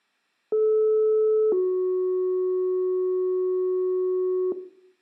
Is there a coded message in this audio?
Yes: two-tone page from 0.5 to 4.5 s, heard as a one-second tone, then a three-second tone, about 430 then 370 Hz, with room echo.